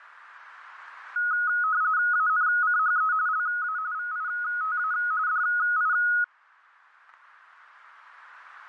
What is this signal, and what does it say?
RTTY (45.45 baud, 170 Hz shift), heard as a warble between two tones, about 1360 Hz centre. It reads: ANCHE LA VITA DI